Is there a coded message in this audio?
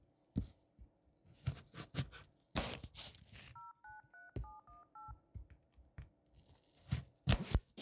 Yes: DTMF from 3.6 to 5.1 s, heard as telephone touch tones, dialled by hand, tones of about 160 ms, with kitchen noise. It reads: 093718